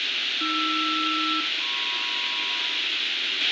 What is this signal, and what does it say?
Aircraft SELCAL, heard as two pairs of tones, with radio hiss, a squelch burst at the end and room echo. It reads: AR-MP